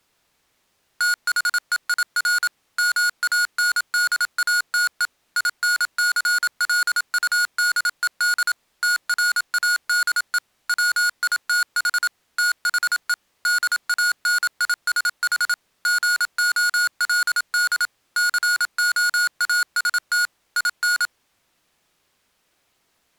Morse code, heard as electronic beeps, machine-sent, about 27 wpm, 1440 Hz. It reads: THEIR MANDATE INCLUDED TRADE WITH THE DANISH GOLD COAST IN